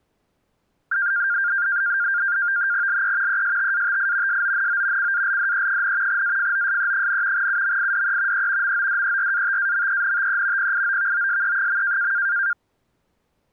NAVTEX (SITOR-B), 100 baud, 170 Hz shift, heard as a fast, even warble, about 1500 Hz centre. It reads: LE ESTATI SONO CALDE, AFOSE, UMIDE E MODERATAMENTE PIOVOSE.